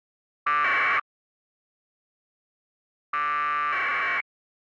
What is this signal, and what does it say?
Packet radio (AX.25, as in APRS), 1200 baud, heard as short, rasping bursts.